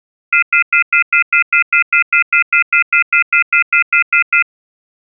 Telephone call progress tone (North American plan), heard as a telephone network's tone, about 1400, 2050, 2450, 2600 Hz, 0.1 s on and 0.1 s off. Off-hook warning tone.